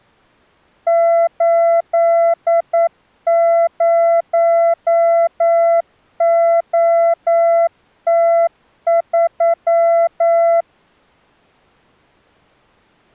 Morse code, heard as a keyed tone, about 9 wpm, 670 Hz. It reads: 80OT3